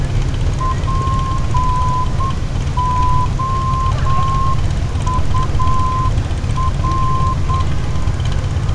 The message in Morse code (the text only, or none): POUR